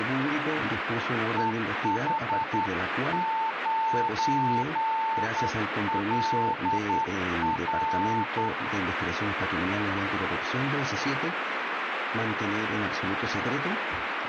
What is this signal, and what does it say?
Morse code, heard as a keyed tone, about 10 wpm, 890 Hz, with radio static. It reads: EH9LR